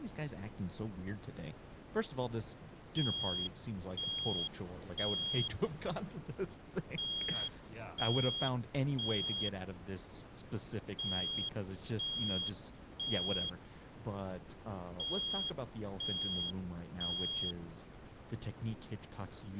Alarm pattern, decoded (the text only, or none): temporal three